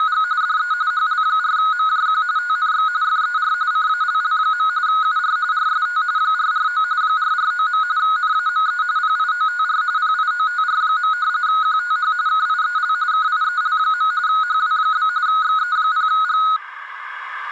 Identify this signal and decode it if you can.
RTTY (45.45 baud, 170 Hz shift), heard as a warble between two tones, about 1360 Hz centre, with room echo. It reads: … DE HL4MJQ TNX FER CALL. UR RST 449 449. NAME PIOTR PIOTR. QTH KIEL KIEL. HW? XE0G